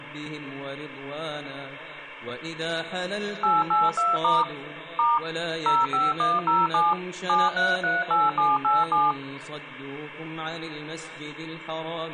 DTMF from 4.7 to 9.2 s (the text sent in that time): * 05107 7338787